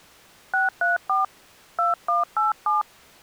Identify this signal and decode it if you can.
DTMF, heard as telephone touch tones, dialled by hand, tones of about 150 ms. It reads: 634 2187